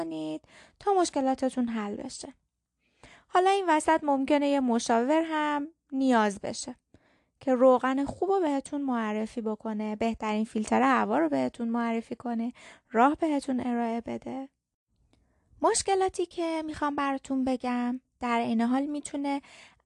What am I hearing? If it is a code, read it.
Speech in Persian. There is no code.